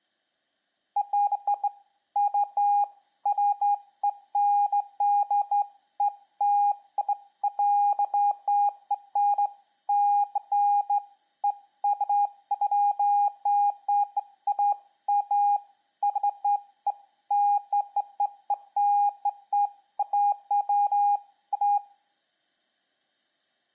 Beeps of irregular length, with room echo. There is no code.